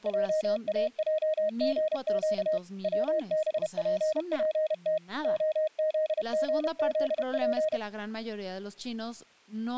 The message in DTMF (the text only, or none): none